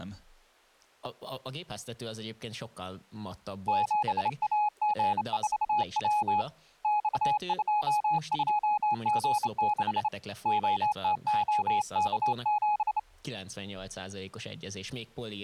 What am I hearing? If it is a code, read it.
Morse code, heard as a keyed tone, hand-sent with a straight key, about 28 wpm, 840 Hz, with speech in Hungarian. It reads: 7AG4W X22G6 OTOK7